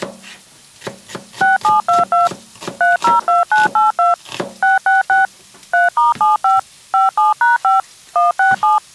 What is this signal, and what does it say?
DTMF, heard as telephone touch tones, dialled by machine, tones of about 150 ms, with kitchen noise. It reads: 6722 302982 666 3*75 57#5 167